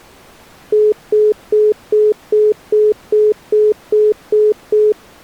Telephone call progress tone (single-tone plan, as in most of Europe), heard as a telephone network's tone, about 420 Hz, 0.2 s on and 0.2 s off. Congestion tone.